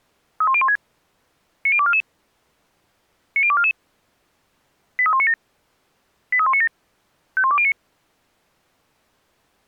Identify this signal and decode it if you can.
Five-tone selective call (ZVEI), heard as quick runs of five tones, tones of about 70 ms. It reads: 31016 90244 90244 83197 83197 51209